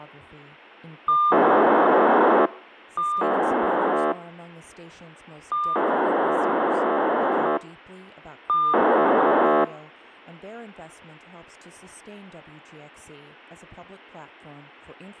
POCSAG pager data (2400 baud), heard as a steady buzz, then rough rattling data.